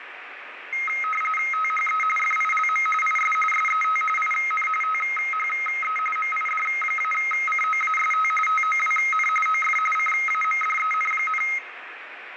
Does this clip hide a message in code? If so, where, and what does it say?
Yes: RTTY (45.45 baud, 850 Hz shift) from 0.7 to 11.6 s, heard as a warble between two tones, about 1700 Hz centre, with radio static and room echo. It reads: THE FILM IS SET IN THE MID-COAST TOWN OF CAMDEN,